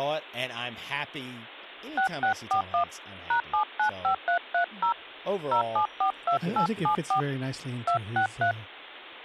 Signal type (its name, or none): DTMF